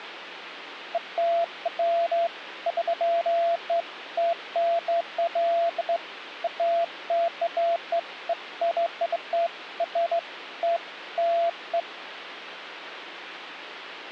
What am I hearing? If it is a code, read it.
Beeps of irregular length, with phone line noise. There is no code.